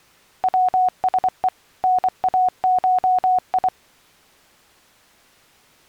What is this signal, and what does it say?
Morse code (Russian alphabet), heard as a keyed tone, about 24 wpm, 730 Hz. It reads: ВСЕ НАШИ